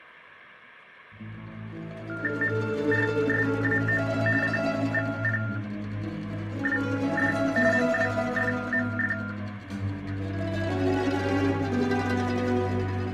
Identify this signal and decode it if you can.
TTY/TDD text telephone tones (45.45 baud Baudot), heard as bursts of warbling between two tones, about 400 Hz shift, 1600 Hz centre. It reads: MRSAO CVPWD MWFMF